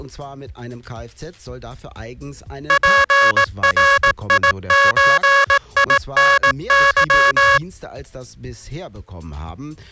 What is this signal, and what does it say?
Morse code (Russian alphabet), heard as a buzzer, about 18 wpm. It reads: ПРИЧИНЫ